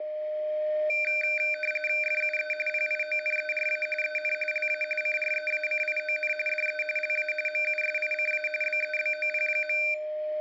RTTY (45.45 baud, 850 Hz shift), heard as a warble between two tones, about 1950 Hz centre, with a steady whistle near 610 Hz and room echo. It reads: FUE PIONERA EN LA CREACION DE LA MUSICA BEBOP.